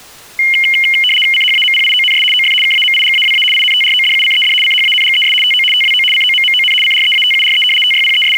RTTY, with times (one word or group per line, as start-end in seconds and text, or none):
1.3-2.2 CHAMPIONS
2.3-2.5 OF
2.6-3.4 KAMIGAWA
3.5-4.5 INTRODUCED
4.6-5.3 CHANGES
5.4-5.6 TO
5.7-6.0 TWO
6.1-6.7 COMMON
6.8-7.6 CREATURE
7.8-8.4 …